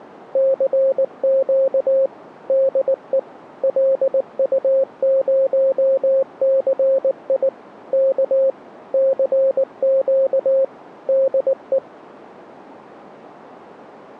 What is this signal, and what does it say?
Morse code, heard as a keyed tone, machine-sent, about 19 wpm, 540 Hz. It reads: CQ DE LU0CI K CQ DE